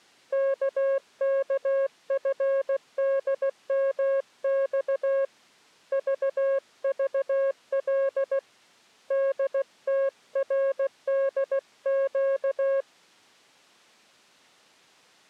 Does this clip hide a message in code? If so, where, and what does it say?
Yes: Morse code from 0.3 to 12.9 s, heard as a keyed tone, hand-sent with a paddle, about 16 wpm, 540 Hz. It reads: KKFDMX VVL DTRDQ